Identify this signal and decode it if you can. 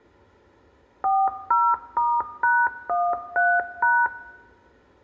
DTMF, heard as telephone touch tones, dialled by machine, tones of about 240 ms, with room echo. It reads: 40*#13#